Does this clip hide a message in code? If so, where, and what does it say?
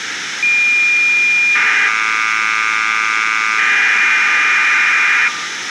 Yes: cassette data (Kansas City type), 1200 baud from 0.4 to 5.3 s, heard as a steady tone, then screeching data, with tape hiss.